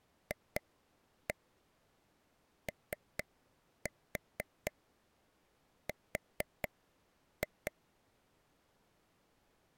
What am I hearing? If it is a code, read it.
Tap code, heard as taps on a table, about 4 knocks a second. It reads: FOR